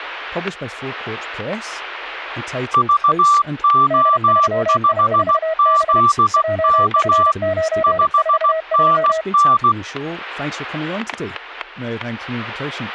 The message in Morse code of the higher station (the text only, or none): VO5ZK 5NN